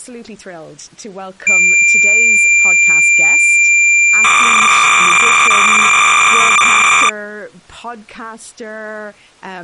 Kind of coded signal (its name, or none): cassette data (Kansas City type)